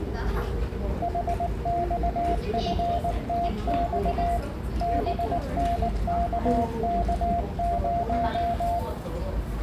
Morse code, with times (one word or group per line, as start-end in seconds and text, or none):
1.0-4.4 HXFTX
4.8-8.8 BNKK0